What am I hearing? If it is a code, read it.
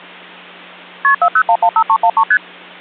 Multi-frequency trunk signalling (R1, as on North American trunks), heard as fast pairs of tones, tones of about 70 ms, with hum. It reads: KP 40115313 ST